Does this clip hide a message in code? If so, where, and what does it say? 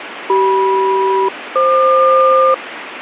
Yes: aircraft SELCAL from 0.3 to 2.5 s, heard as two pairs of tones, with radio static. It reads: CM-FQ